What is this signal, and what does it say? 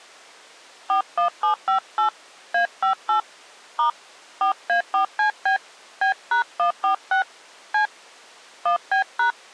DTMF, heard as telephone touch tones, dialled by hand, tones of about 110 ms. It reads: 41758 A58 * 4A4CB B#146 C 1B#